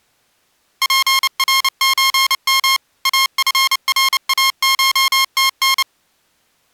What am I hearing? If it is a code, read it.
Morse code (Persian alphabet), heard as electronic beeps, machine-sent, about 29 wpm, 1070 Hz. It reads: پرچم افراشتن